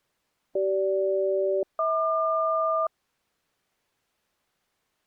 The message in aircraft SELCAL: CG-HQ

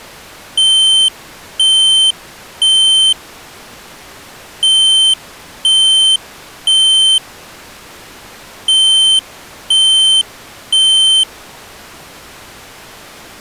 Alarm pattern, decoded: temporal three

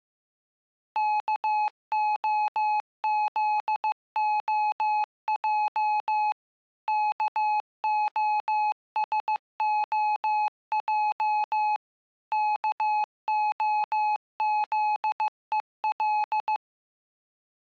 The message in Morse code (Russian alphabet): КОЗОЙ КОСОЙ КОЗЕЛ

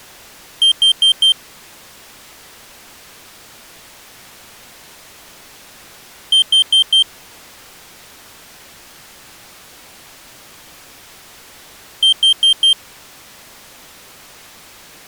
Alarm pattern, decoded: temporal four

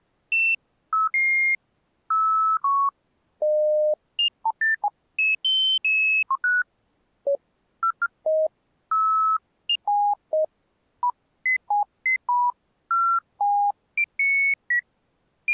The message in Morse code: none

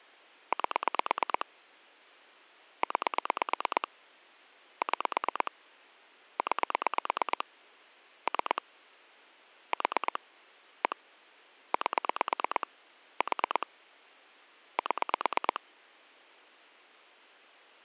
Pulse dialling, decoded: 8 9 6 9 3 4 1 8 4 7

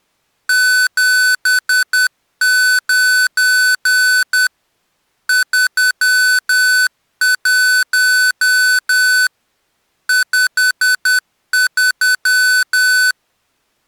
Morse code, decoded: 79 31 53

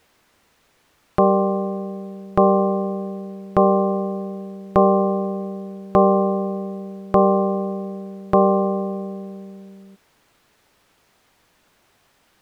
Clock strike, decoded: 7

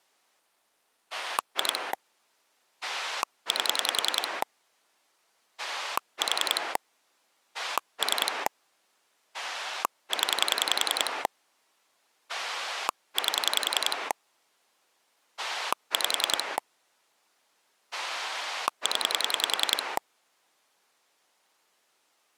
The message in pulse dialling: 2 8 4 3 0 8 5 0

